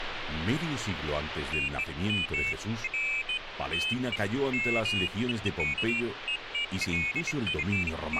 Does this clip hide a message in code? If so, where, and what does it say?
No, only pairs of high tones at irregular times, with radio static.